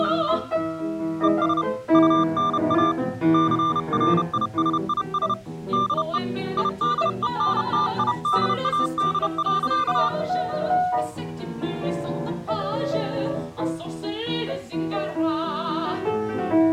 Morse code, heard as a keyed tone, hand-sent with a paddle, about 31 wpm, 1190 Hz. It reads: ES UNA CRISIS DE IDENTIDAD.